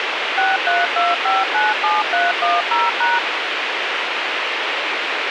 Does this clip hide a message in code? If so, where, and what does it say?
Yes: DTMF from 0.4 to 3.2 s, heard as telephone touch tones, dialled by machine, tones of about 180 ms, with radio hiss. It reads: 632597310#